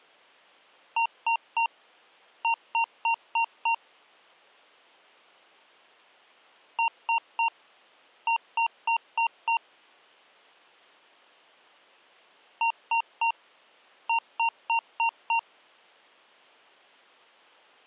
Beep code, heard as beeps from a small speaker, played three times, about 920 Hz. 3-5.